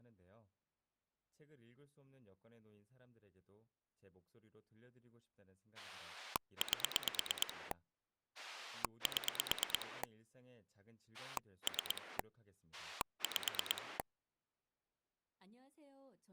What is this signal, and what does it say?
Pulse dialling, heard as a rotary dial, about 9 pulses a second, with speech in Korean. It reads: 8 7 3 5